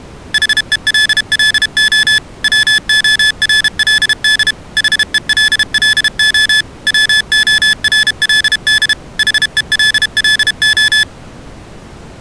Morse code, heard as electronic beeps, machine-sent, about 32 wpm, 1750 Hz. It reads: HELLO WORLD HELLO WORLD HELLO